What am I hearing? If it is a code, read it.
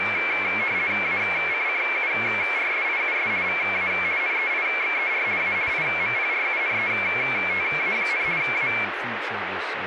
RTTY (50 baud, 170 Hz shift), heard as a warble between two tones, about 2250 Hz centre, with radio static and speech in English. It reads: ACCURSIUS VA NEIXER A IMPRUNETA, A